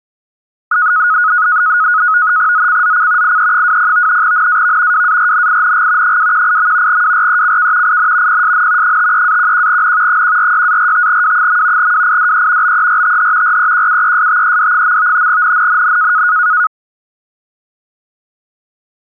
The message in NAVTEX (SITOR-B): ZCZC IE20 NAV WARNING 218. WRECK IN PSN 53-11N 146-45W. WIDE BERTH REQUESTED. NNNN

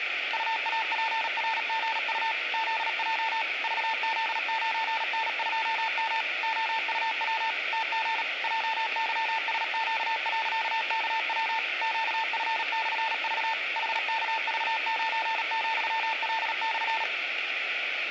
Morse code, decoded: UAPRGU ZJ VZ9N2M OUW TG JYSQ.KW QF/V HKV9,L/

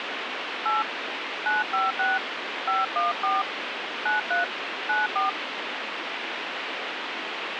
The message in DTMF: 8 956 514 93 94

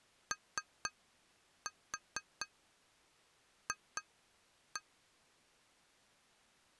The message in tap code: OF

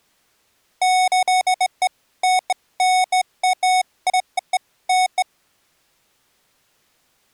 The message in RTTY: none

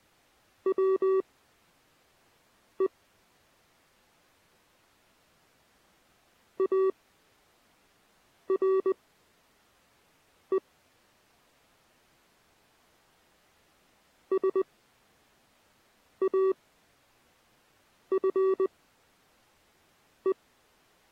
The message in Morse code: WE ARE SAFE

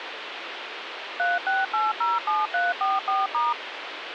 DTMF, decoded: 36807344*

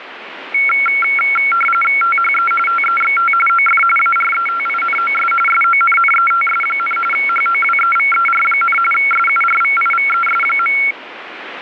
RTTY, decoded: THE TEXT OF ARETINOS SONNETS, HOWEVER, SURVIVES.

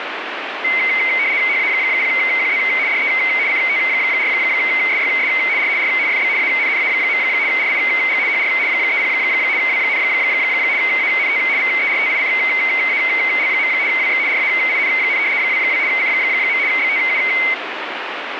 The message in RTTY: HA0QZ DE CT4SYS R R FB ANNA. RIG HR 30 W, ANT VERTICAL. WX RAIN, 22 C. BTU

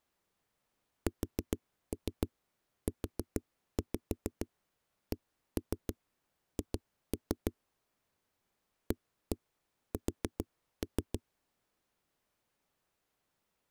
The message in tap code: SUCH AS

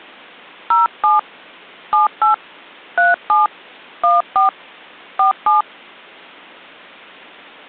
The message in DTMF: 07 78 37 14 47

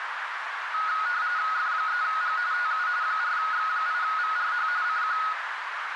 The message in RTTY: F3G TU 4X8VRH CQ

